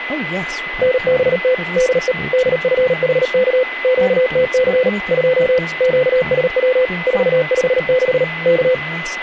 Morse code, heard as a keyed tone, machine-sent, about 38 wpm, 510 Hz, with radio static, a steady whistle near 2020 Hz and speech in English. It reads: NBT DE DFHK QTC 2 QSW 456 K